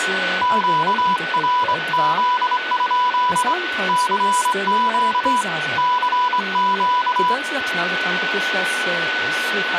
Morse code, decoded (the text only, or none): QRZ? CQ CQ